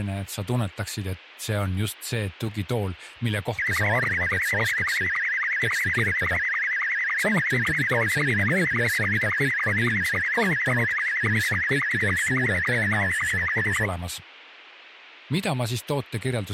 SSTV (slow-scan television), Scottie S2, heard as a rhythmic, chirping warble, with radio hiss and speech in Estonian.